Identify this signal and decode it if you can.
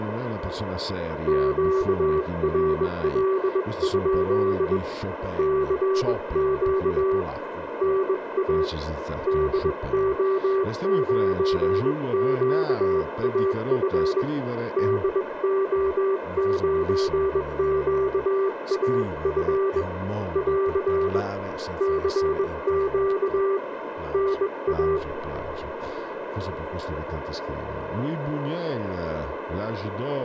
Morse code, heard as a keyed tone, hand-sent with a bug key, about 21 wpm, 390 Hz, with radio static, a narrow filter, room echo and speech in Italian. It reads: QRL? CQ NA DO9QAF DO9QAF <AR> CQ NA